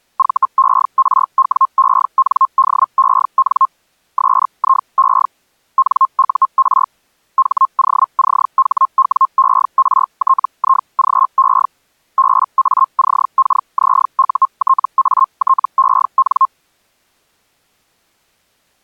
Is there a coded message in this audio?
Yes: Hellschreiber (Feld-Hell, 122.5 baud) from 0.2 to 16.5 s, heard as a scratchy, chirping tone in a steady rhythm, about 1060 Hz. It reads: VERWENDEN SIE NUR HOCHWERTIGE BACKZUTATEN